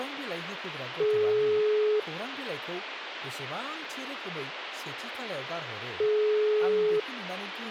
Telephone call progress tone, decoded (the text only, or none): ringback tone